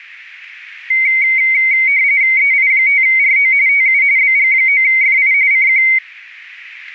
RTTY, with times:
2.4-3.5 EI5RO
3.7-4.0 TU
4.2-5.3 BG9FI
5.5-5.8 CQ

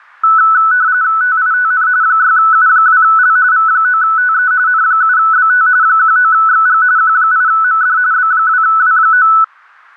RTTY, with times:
1.2-1.9 TITN
2.0-3.4 6U2L
3.5-4.5 V9TE
4.7-5.7 N7BT
5.8-6.8 19XG
7.0-8.0 Q8MD
8.1-9.3 B2W9

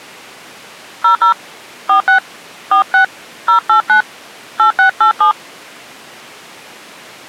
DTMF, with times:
1.0-1.3 00
1.9-2.2 46
2.7-3.0 46
3.5-4.0 089
4.6-5.3 8687

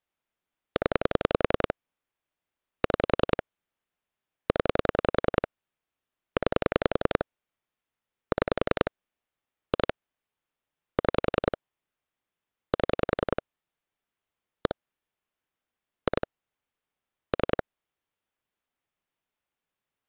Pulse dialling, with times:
0.8-1.7 0
2.8-3.4 6
4.5-5.5 0
6.4-7.2 9
8.3-8.9 6
9.7-9.9 2
11.0-11.6 6
12.7-13.4 7
14.7-14.7 1
16.1-16.3 2
17.3-17.6 3

